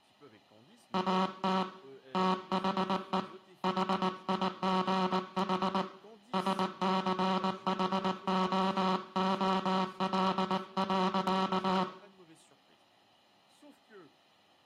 Morse code, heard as a buzzer, hand-sent with a paddle, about 19 wpm, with room echo and speech in French. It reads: AT THE HIGH SCHOOL.